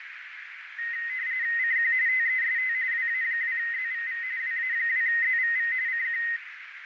RTTY (45.45 baud, 170 Hz shift), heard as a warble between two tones, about 1950 Hz centre, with radio static and a narrow filter. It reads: CQ TEST WA2ZVV WA2ZVV CQ